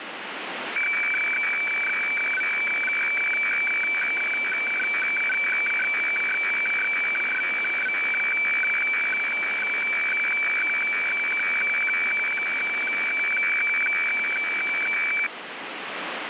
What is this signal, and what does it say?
Weather fax (radiofax), 120 lines a minute, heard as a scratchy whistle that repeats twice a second, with radio static.